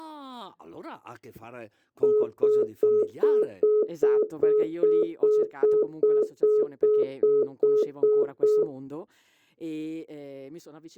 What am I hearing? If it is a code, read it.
Telephone call progress tone (single-tone plan, as in most of Europe), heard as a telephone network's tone, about 420 Hz, 0.2 s on and 0.2 s off, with speech in Italian. Congestion tone.